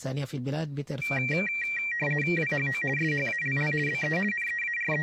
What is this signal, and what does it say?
RTTY (50 baud, 450 Hz shift), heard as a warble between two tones, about 2100 Hz centre. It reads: WHO SHALL BE …